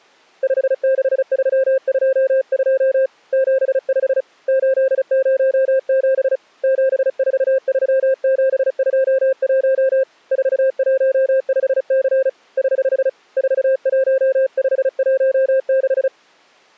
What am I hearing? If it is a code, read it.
Morse code, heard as a keyed tone, hand-sent with a paddle, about 35 wpm, 530 Hz. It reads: 56322 75 807 743721 415C <HH> 41516